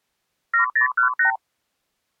Multi-frequency trunk signalling (R2, with the far end's replies), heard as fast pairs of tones, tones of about 110 ms. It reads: 7018